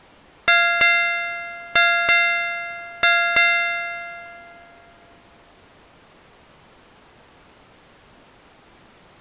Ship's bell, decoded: 6

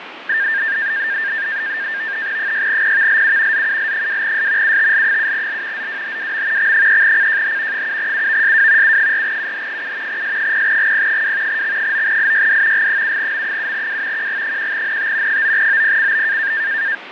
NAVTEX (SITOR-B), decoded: 6PVLU ZUL2S UTL7L ZWHWM X3CJH 7UVSW U4UH7 S0GP2 X9IYD G7M7W QG1NT 9OPCB

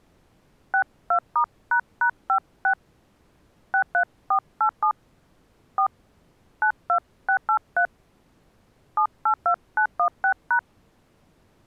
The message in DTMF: 62*##56 63487 4 92683 782916#

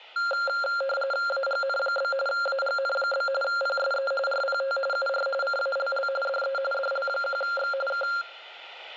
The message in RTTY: AGN? AGN? PSE RPT UR CALL DE DL1X K

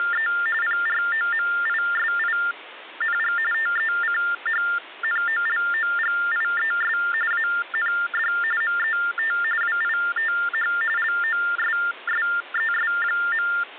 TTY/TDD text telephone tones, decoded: … PROMISING TECHNOLOGIES AND MET WITH LOSSES.

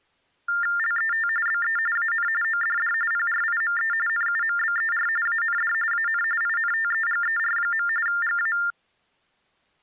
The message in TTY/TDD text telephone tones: LET BE AN ODD PRIME NUMBER AND AN INTEGER. GA

